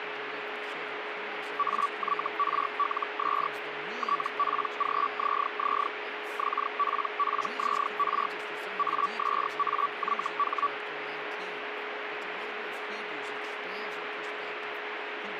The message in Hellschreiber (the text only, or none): AYRLS TPGZZ XPPZR ASAYH